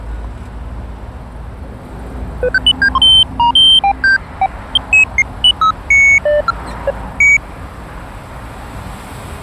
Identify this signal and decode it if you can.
Electronic bleeps of random pitch and length, with street noise. There is no code.